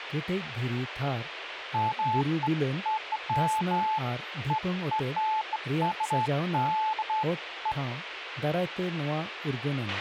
Beeps of irregular length, with radio hiss, a squelch burst at the end and speech in Santali. There is no code.